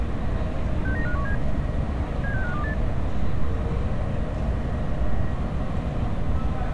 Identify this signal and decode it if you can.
Five-tone selective call (CCIR), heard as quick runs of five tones, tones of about 100 ms, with street noise. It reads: 69517 76528